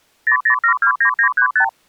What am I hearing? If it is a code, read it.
Multi-frequency trunk signalling (R2, with the far end's replies), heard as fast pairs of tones, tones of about 90 ms. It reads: 00729935